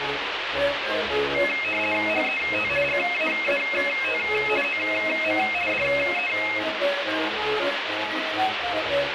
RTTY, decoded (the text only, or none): HET GAAT OM DE